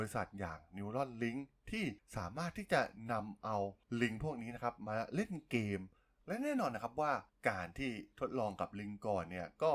Speech in Thai. There is no code.